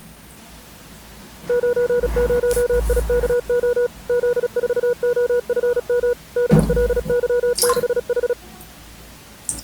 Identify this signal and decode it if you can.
Morse code, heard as a keyed tone, machine-sent, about 36 wpm, 480 Hz, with the noise of a restroom. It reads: 90IKO Z4OFM DLY6H